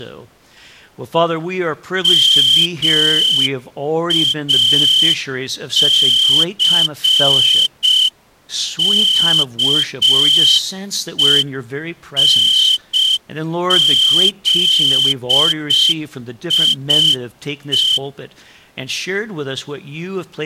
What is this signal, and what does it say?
Morse code, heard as a whistle, hand-sent with a straight key, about 6 wpm. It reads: MACKENZIE